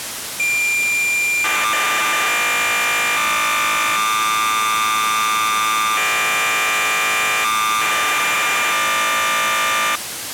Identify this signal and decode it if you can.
Cassette data (Kansas City type), 1200 baud, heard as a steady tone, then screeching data, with tape hiss.